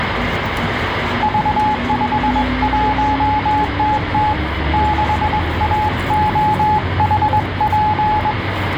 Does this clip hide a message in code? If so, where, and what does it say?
Yes: Morse code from 1.2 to 8.4 s, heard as a keyed tone, hand-sent with a straight key, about 21 wpm, 850 Hz, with radio static and the noise inside a bus. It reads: V51TT 6AOHP